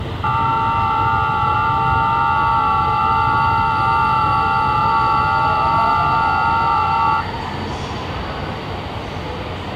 FT8 (several signals at once), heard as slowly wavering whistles, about 6.25 baud, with radio static, room echo and the noise of a subway station.